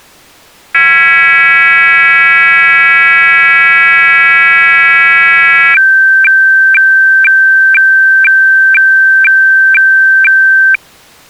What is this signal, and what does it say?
Weather fax (radiofax), 120 lines a minute, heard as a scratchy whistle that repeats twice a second.